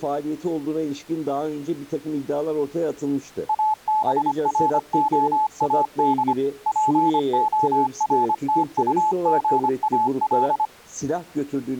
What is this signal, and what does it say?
Morse code, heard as a keyed tone, machine-sent, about 25 wpm, 860 Hz. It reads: ABROAD PORTUGAL